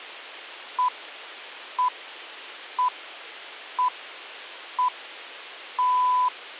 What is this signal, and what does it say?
Radio time signal (six pips, as the Greenwich Time Signal), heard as pips, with a squelch burst at the end.